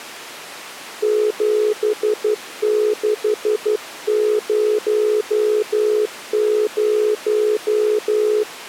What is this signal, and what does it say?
Morse code, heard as a keyed tone, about 12 wpm, 420 Hz. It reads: 7600